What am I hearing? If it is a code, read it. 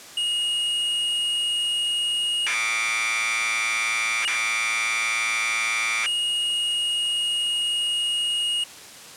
Commodore tape loading (standard loader), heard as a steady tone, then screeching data.